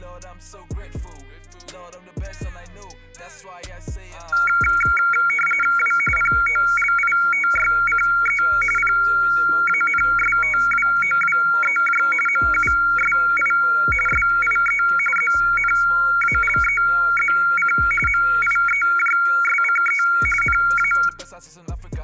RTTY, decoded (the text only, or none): W POLITYCE PANSTWOWEJ MUSI SIE ZNALEZC MIEJSCE NA